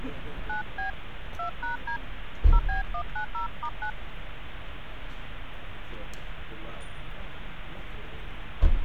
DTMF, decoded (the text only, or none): 9B 2#D 0B190*9